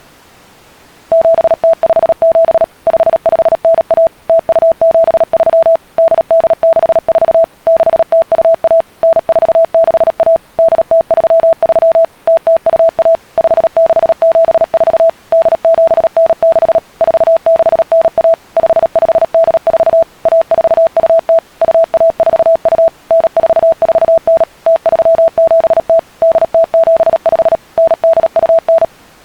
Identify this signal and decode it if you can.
Morse code (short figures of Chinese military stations), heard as a keyed tone, machine-sent, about 37 wpm, 660 Hz. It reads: 7057 5591 0273 8864 6021 9461 8033 0021 5674 8796 4691 5584 1420 2142 9449 0370 8075 9829